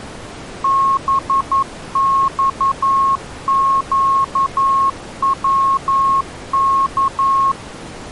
Morse code, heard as a keyed tone, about 11 wpm, 1090 Hz. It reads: BXQWK